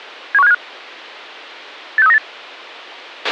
Five-tone selective call (EEA), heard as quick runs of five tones, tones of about 40 ms, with a squelch burst at the end. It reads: 71575 86398